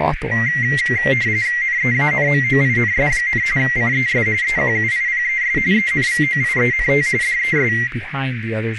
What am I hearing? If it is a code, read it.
RTTY (45.45 baud, 170 Hz shift), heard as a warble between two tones, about 2000 Hz centre, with radio static, a narrow filter and speech in English. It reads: NEANMOINS, CES EQUIPES ENVOIENT DES